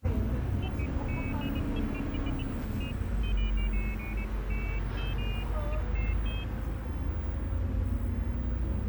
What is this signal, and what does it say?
Pairs of high tones at irregular times, with the noise inside a bus. There is no code.